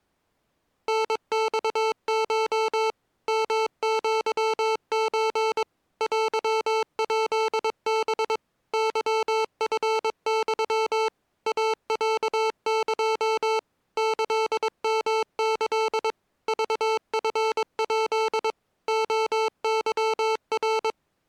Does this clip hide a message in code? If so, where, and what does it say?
Yes: Morse code (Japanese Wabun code) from 0.8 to 21.0 s, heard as electronic beeps, machine-sent, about 22 wpm, 440 Hz. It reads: タマコ ヨアソ テヱハ ケチユ イロエ キヨキ クチヱ レケナ